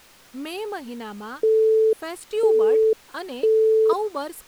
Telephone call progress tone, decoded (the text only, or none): busy tone